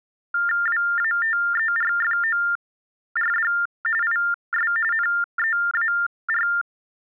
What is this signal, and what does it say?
TTY/TDD text telephone tones (45.45 baud Baudot), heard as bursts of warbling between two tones, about 400 Hz shift, 1600 Hz centre. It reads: WATERFORD IS NEAR